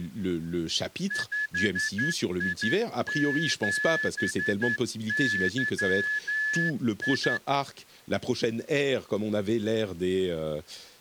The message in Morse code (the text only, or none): 5I7YI